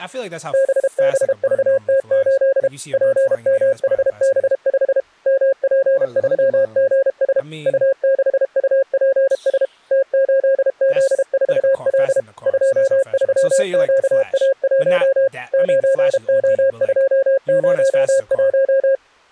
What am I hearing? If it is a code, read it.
Morse code, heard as a keyed tone, machine-sent, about 32 wpm, 540 Hz, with speech in English. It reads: BBVT8 PMHB5 MP3GS U6UPS T8Z4L 23QA1 9O201